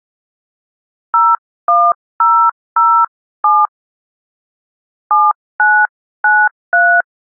DTMF, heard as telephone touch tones, dialled by hand, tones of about 250 ms. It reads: 01007 7993